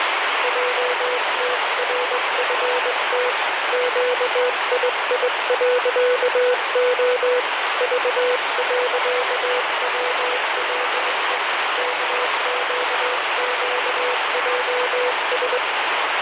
Morse code, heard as a keyed tone, hand-sent with a straight key, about 21 wpm, 500 Hz, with heavy radio static. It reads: JTRFT QII.O V.WLE KQQJS